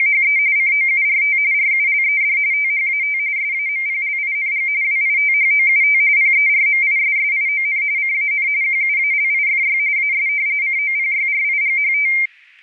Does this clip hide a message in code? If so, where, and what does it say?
Yes: RTTY (45.45 baud, 170 Hz shift) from 0.0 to 12.3 s, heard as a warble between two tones, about 2200 Hz centre, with static crashes. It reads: … COURT RULED THAT SAMPLING WITHOUT PERMISSION CAN QUALIFY AS COPYRIGHT